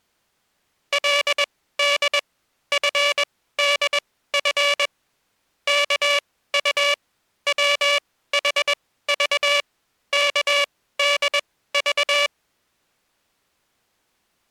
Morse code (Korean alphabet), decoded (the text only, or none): 그는 이불을